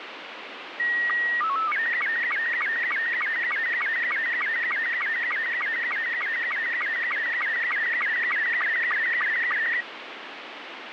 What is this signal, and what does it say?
SSTV (slow-scan television), Robot 72, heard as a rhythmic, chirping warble, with radio static.